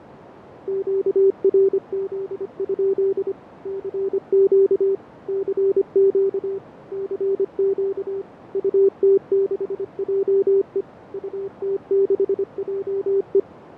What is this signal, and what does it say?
Morse code, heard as a keyed tone, machine-sent, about 25 wpm, 390 Hz, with radio static, fading and a narrow filter. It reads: QRZ? CQ CQ CQ UT6JE UT6JE